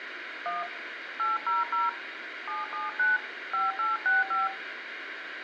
DTMF, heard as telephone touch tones, dialled by hand, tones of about 170 ms, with radio hiss. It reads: 1 800 779 5865